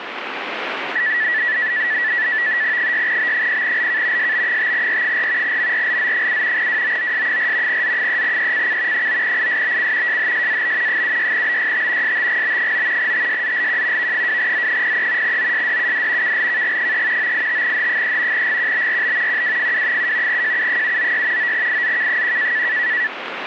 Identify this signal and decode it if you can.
NAVTEX (SITOR-B), 100 baud, 170 Hz shift, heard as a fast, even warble, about 1850 Hz centre, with radio static. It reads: 6B0LK SB5R4 MRLZ7 WOOS4 Z3ECC 9ISBC JHSAB 76BYT STGB9 TSZLQ V2Z03 OSDUD KLKG3 985H3 GQBRB QWFW7 JU796 9IZK1